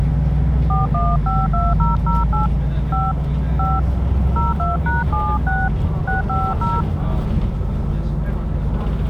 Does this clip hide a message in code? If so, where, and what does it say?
Yes: DTMF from 0.7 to 6.8 s, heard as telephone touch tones, dialled by hand, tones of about 190 ms, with the noise inside a bus. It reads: 4152008 5 5 02#76 650